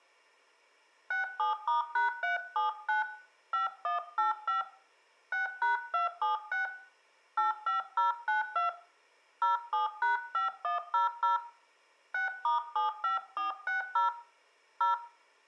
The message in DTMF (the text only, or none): 67*#379 5185 6#276 85092 07#5100 6*75460 0